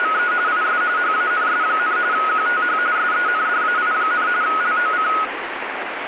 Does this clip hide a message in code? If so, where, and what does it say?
Yes: RTTY (45.45 baud, 170 Hz shift) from 0.0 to 5.2 s, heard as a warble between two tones, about 1360 Hz centre, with radio static. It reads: … IS HANS, QTH SENDAI, LOC